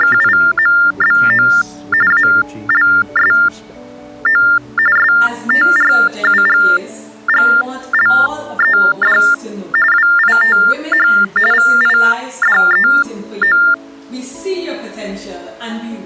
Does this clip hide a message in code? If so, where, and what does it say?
Yes: TTY/TDD text telephone tones (45.45 baud Baudot) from 0.0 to 13.7 s, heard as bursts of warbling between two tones, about 400 Hz shift, 1600 Hz centre. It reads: … ALSO STRUGGLED WITH VIDEO